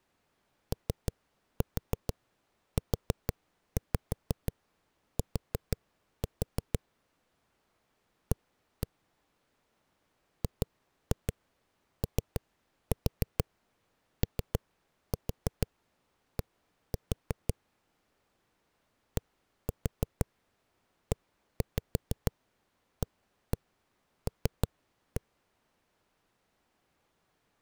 Tap code, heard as knocks on a wall, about 6 knocks a second. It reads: OUT A GOOD DEAL